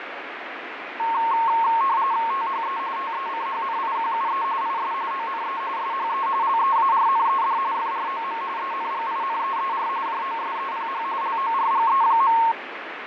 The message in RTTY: THE TECHNIQUE IS ONE SHE LEARNED FROM ENGINEER JOSEPH LORGE.

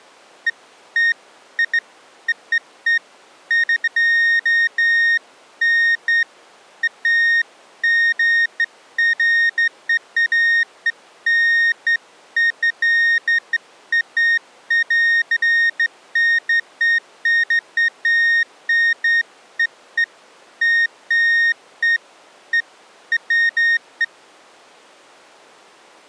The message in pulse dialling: none

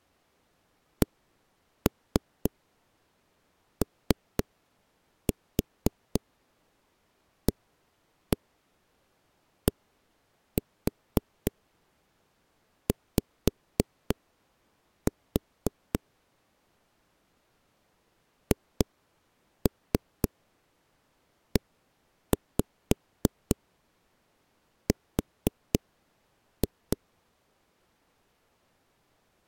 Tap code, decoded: COADY HER

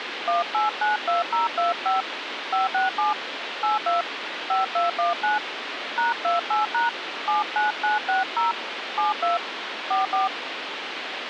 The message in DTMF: 1892025 567 82 5219 #28# 79960 72 44

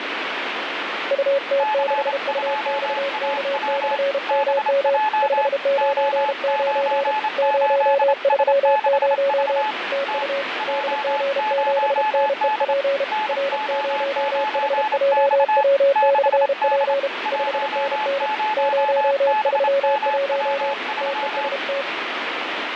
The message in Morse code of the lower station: UT6UXK/MM 599 030 TU DG7NEP R0HJW/P 5NN 031 TEST

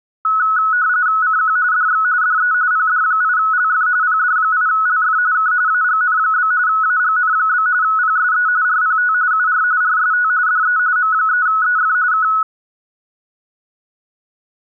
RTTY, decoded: CQ DX DE PD8LF PD8LF K AGN? AGN? PSE RPT UR RST DE M3EF K

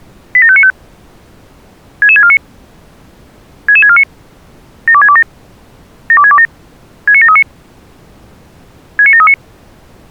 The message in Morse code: none

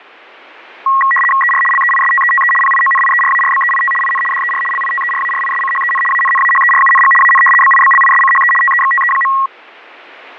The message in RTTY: ER LEISTETE PIONIERARBEIT IN DER LITERARISCHEN ANNAHERUNG AN BIBLISCHE TEXTE.

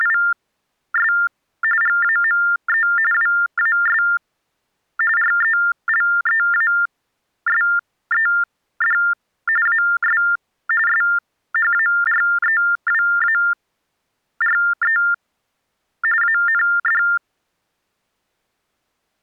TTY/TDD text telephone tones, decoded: … GAME WAS RELEASED AS SHAREWARE AND

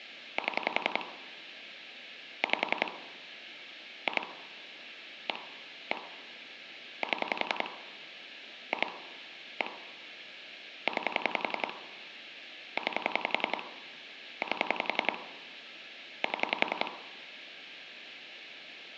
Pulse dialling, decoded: 7 5 2 1 1 7 2 1 9 9 8 7

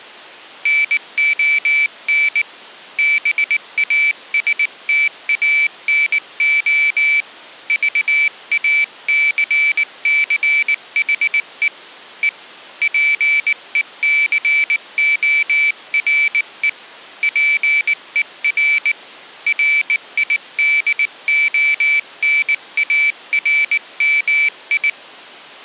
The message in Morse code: NON BASTANO VACCHE E PECORE PER RIDONARMI

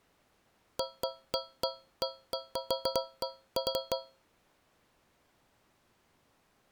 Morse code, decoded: none

